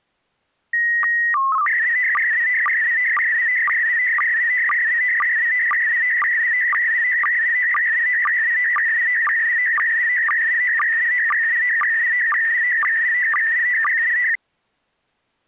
SSTV (slow-scan television), PD 120, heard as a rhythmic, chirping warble.